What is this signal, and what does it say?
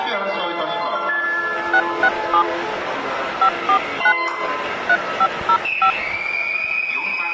DTMF, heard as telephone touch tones, dialled by hand, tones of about 70 ms. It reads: 667 549 3505